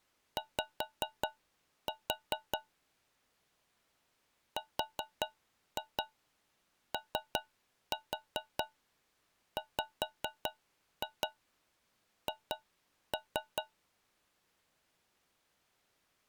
Tap code, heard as taps on a metal pipe, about 4 knocks a second. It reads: Y ROWH